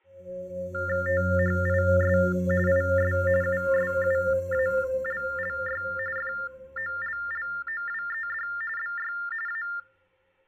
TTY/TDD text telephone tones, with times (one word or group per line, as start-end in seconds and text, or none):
1.1-2.2 THIS
2.7-3.1 IS
3.4-5.8 USUALLY
6.2-8.5 FOLLOWED
8.8-9.1 BY
9.5-9.6 A